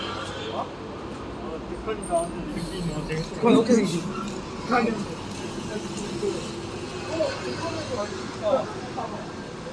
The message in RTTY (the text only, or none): none